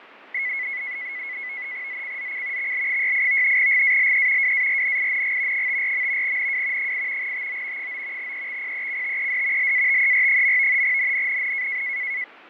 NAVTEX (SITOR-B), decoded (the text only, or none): ZCZC XL68 GALE WARNING 54. NW 8 TO 9 EXPECTED LATER. NNNN